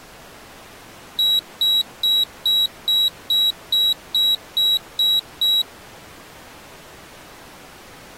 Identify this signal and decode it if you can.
Beep code, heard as a piezo beeper, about 3900 Hz. 11 short. In AMI BIOS tables: cache memory error.